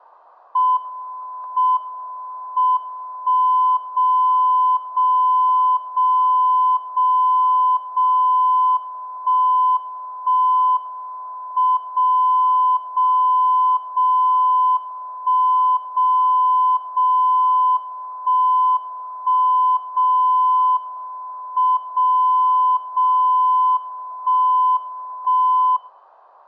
Radio time signal (WWVB), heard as a tone whose level steps once a second, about 1010 Hz, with static crashes. The time is 16:43 UTC. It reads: M M 1 0 0 0 0 0 1 1 M 0 0 0 1 0 0 1 1 0 M 0 0 1 1